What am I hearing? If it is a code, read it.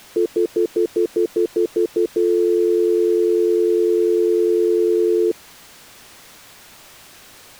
Telephone call progress tone (North American plan), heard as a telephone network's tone, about 350, 440 Hz, 0.1 s on and 0.1 s off. Stutter dial tone.